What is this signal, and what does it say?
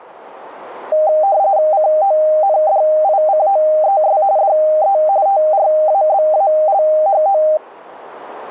RTTY (45.45 baud, 170 Hz shift), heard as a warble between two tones, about 700 Hz centre. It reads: CONDICOES DE TRABALHO